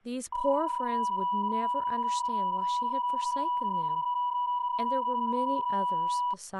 PSK31 (31.25 baud), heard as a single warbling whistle, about 980 Hz, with speech in English.